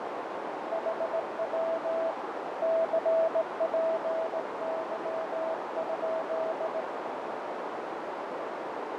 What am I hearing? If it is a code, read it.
Morse code, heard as a keyed tone, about 18 wpm, 650 Hz, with heavy radio static, fading and a narrow filter. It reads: HW CPY?